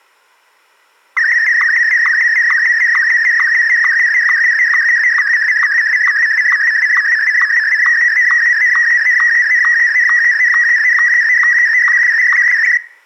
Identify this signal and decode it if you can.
SSTV (slow-scan television), Martin M1, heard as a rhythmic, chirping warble.